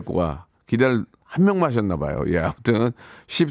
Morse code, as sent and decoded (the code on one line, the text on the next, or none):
none